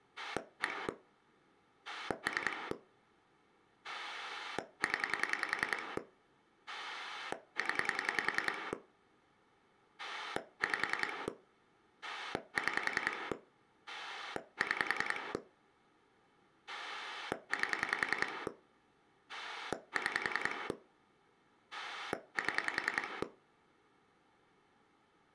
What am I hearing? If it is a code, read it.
Pulse dialling, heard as a rotary dial, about 10 pulses a second. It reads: 1 3 0 0 5 6 6 8 6 7